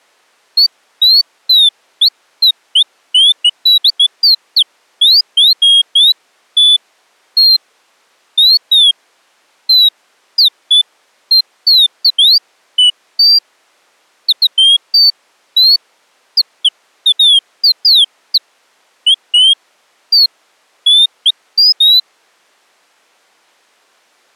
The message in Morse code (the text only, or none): none